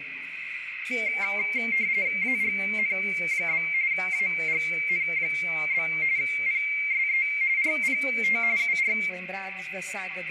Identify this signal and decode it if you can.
RTTY (45.45 baud, 170 Hz shift), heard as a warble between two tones, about 2200 Hz centre, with radio static and a narrow filter. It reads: AGN? AGN? PSE RPT UR